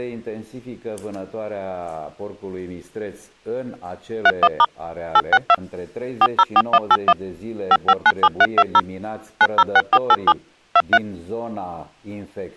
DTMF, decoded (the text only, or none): 31* 862 404181 5597320 906487 23